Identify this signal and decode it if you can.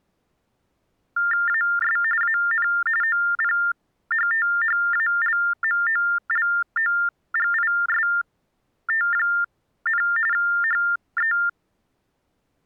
TTY/TDD text telephone tones (45.45 baud Baudot), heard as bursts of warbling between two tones, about 400 Hz shift, 1600 Hz centre. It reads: AS AN OPHTHALMOLOGIST, HE